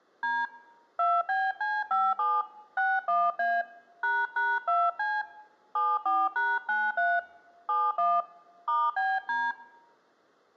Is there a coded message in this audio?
Yes: DTMF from 0.2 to 9.5 s, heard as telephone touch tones, dialled by hand, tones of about 220 ms. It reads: D 2BC57 61A ##2C 74#93 71 *BD